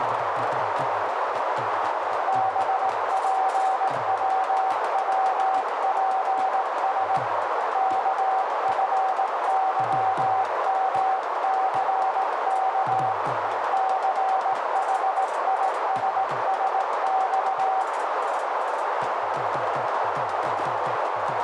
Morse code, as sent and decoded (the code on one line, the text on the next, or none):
-... .--. .-- .-- .--. ... / -.- ..-. -.-- -- -.-. -.- / -.-. .... .. ... ... -..-
BPWWPS KFYMCK CHISSX